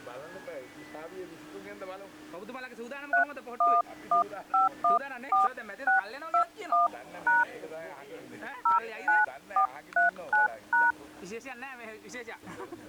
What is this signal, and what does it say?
DTMF, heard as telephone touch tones, dialled by hand, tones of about 150 ms. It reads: 311514621# 09439#